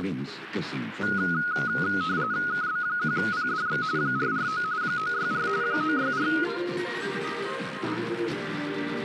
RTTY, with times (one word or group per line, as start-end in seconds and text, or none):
2.5-3.8 KB1PDX
4.0-4.6 449
4.8-5.5 964
5.6-6.3 964